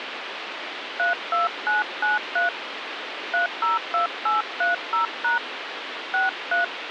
DTMF, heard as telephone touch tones, dialled by hand, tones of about 130 ms, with phone line noise. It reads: 32993 302830# 63